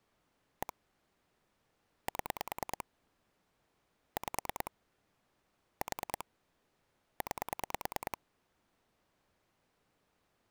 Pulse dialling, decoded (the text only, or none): 1 7 5 4 9